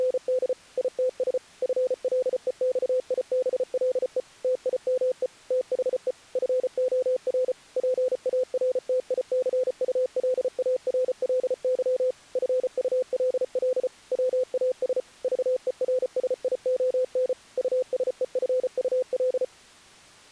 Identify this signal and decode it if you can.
Morse code, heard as a keyed tone, machine-sent, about 34 wpm, 510 Hz. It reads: … ITS FLEXIBLE TIME THE FOR PARTICULARLY FULL WAS VERSION USEFUL